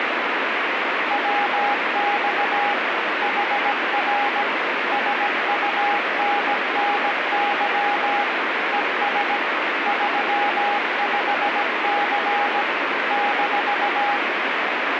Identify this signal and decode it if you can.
Morse code, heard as a keyed tone, machine-sent, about 17 wpm, 820 Hz, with heavy radio static. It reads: WX HR SUNNY ES 35C -